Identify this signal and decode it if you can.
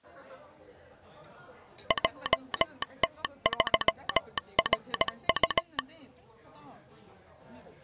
Morse code, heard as a telegraph sounder, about 17 wpm, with the noise of a crowd indoors. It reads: JT3RU